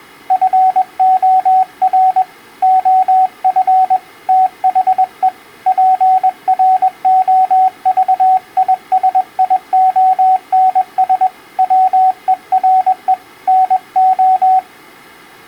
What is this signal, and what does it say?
Morse code, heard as a keyed tone, hand-sent with a paddle, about 21 wpm, 750 Hz. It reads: FOR OF THE PROVISIONS WERE NO